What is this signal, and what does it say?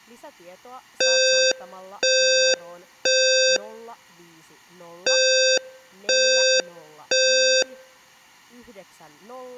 Alarm pattern, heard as an alarm's beeps, played twice, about 520 Hz, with speech in Finnish. Temporal three. Smoke or fire, evacuate.